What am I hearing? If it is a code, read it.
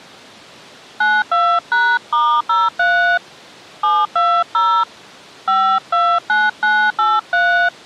DTMF, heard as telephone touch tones, dialled by hand, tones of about 280 ms. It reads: 92#*03 720 529983